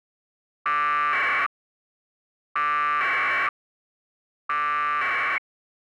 Packet radio (AX.25, as in APRS), 1200 baud, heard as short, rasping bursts.